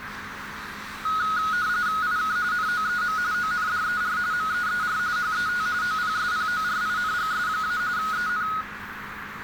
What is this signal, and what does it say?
RTTY (45.45 baud, 170 Hz shift), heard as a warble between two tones, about 1360 Hz centre, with radio static, a narrow filter and street noise. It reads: IK NOEM ONDER MEER HET OPSPORINGS- EN